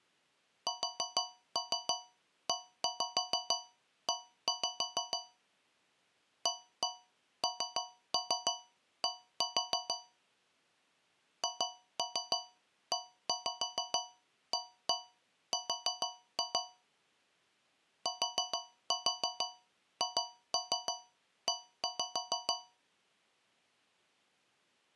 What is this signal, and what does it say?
Tap code, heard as taps on a metal pipe, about 6 knocks a second. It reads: SEE AND HEAR THE